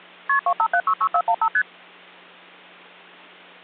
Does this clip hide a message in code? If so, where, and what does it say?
Yes: multi-frequency trunk signalling (R1, as on North American trunks) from 0.3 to 1.6 s, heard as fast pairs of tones, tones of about 70 ms, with hum. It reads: KP 25766415 ST